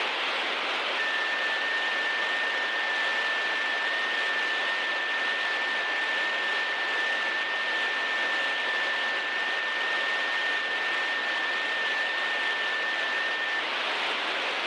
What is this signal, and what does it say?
FT8 (one signal), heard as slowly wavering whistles, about 6.25 baud, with heavy radio static.